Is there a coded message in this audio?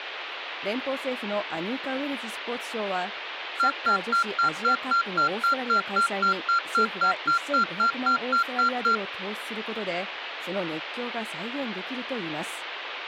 No, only evenly repeated beeps.